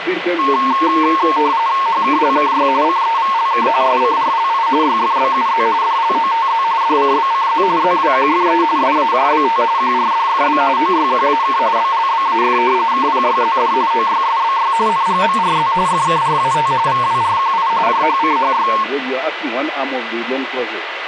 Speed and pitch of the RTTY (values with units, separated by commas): 45.45 baud, 170 Hz shift, 1000 Hz centre